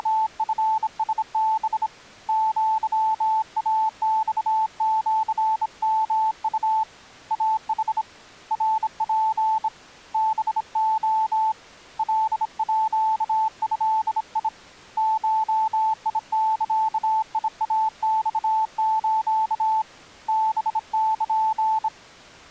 Morse code (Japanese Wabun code), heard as a keyed tone, hand-sent with a bug key, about 26 wpm, 880 Hz. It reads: … アイマシヨウ イヌ ナツ ハレ カード ゴザイマス ハル